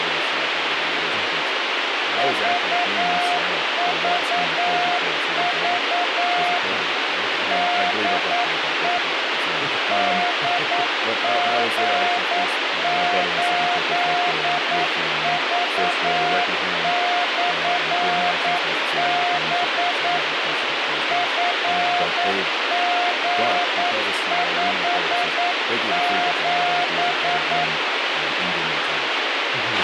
Morse code, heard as a keyed tone, machine-sent, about 9 wpm, 710 Hz, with radio hiss, a squelch burst at the end and speech in English. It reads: VVV DE DG8V/B FG57